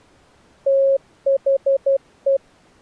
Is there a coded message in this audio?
Yes: Morse code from 0.6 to 2.4 s, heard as a keyed tone, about 12 wpm, 540 Hz. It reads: THE